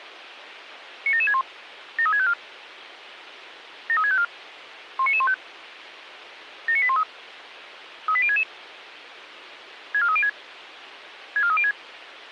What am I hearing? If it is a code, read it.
Five-tone selective call (ZVEI), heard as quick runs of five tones, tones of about 70 ms, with radio hiss. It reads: 97761 73654 73654 19915 79813 38066 64306 64306